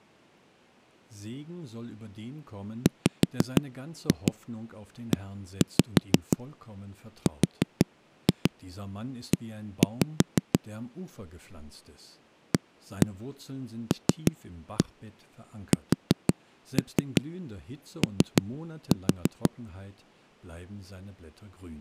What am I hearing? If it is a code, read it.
Tap code, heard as knocks on a wall, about 6 knocks a second, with speech in German. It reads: WERE ALSO